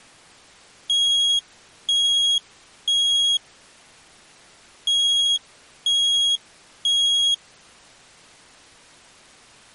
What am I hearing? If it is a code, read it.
Alarm pattern, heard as an alarm's beeps, played twice, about 3300 Hz. Temporal three. Smoke or fire, evacuate.